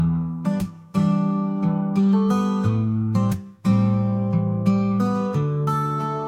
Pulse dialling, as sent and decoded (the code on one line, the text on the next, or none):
none